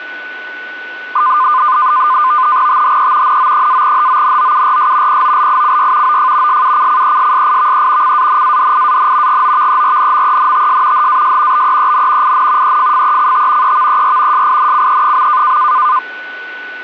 NAVTEX (SITOR-B), 100 baud, 170 Hz shift, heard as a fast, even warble, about 1120 Hz centre, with a steady whistle near 1490 Hz. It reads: THE NO-HONOURS POLICY OF SUCCESSIVE CANADIAN GOVERNMENTS HAS BEEN IN EFFECT EVER SINCE.